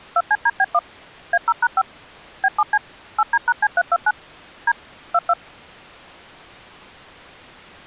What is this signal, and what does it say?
DTMF, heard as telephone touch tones, dialled by machine, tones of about 50 ms. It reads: 2CDB1 A0#5 B7C 8D#C329 D 22